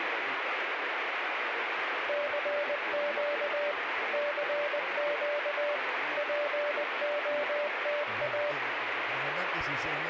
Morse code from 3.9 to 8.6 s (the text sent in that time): CQ POTA